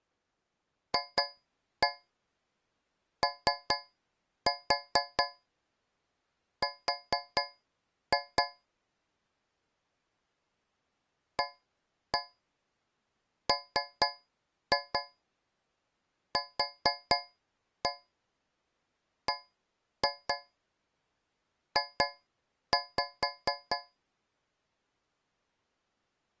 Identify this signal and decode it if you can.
Tap code, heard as taps on a metal pipe, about 4 knocks a second. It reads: FOR AMQBJ